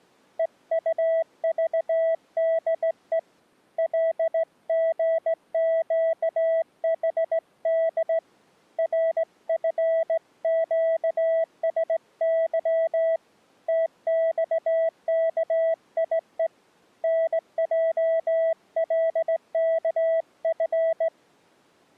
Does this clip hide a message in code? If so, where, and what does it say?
Yes: Morse code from 0.3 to 21.1 s, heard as a keyed tone, hand-sent with a straight key, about 17 wpm, 650 Hz. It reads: EUVDE LGQHD RFQSY TXKIE NJLKF